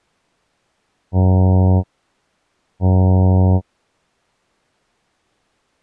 Ship horn signal, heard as a ship's horn, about 90 Hz. 2 short. At sea: I am altering course to port.